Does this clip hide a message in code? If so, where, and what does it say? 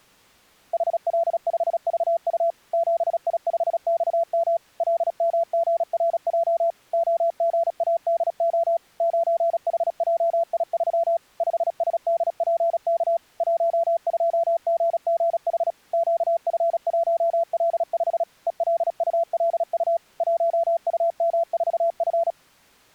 Yes: Morse code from 0.7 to 22.4 s, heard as a keyed tone, machine-sent, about 36 wpm, 670 Hz. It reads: HL5VU 7I5XM LMGRJ OGADO 9HJI3 5SDPK 12GGH QF1L5 ELULU 1UM4F